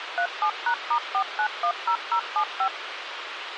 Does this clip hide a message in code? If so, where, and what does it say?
Yes: DTMF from 0.2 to 2.7 s, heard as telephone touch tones, dialled by machine, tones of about 80 ms, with radio hiss. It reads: 37#*4910075